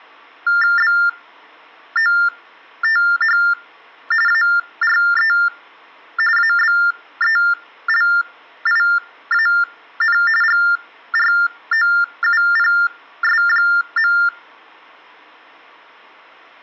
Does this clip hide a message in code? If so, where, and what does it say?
Yes: TTY/TDD text telephone tones (45.45 baud Baudot) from 0.5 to 14.3 s, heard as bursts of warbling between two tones, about 400 Hz shift, 1600 Hz centre. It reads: BOTH ARE ABELIAN GROUPS.